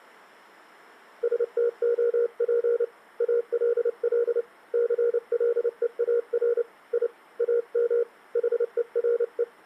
Morse code, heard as a keyed tone, hand-sent with a paddle, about 29 wpm, 470 Hz. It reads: STOP ALL CLEAR I AM HERE